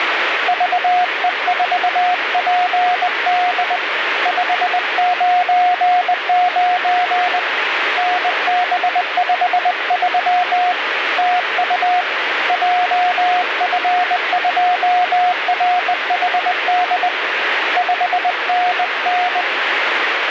Morse code, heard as a keyed tone, hand-sent with a bug key, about 20 wpm, 720 Hz, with radio static. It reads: VE4PD 599 NB53 TU JF2RHD 5NN